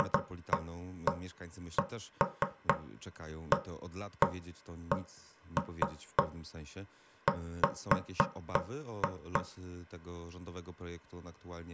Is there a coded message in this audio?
No, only irregular knocks on wood.